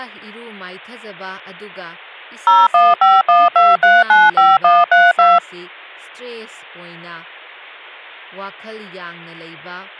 DTMF, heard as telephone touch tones, dialled by machine, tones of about 200 ms, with speech in Manipuri. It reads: 01512395132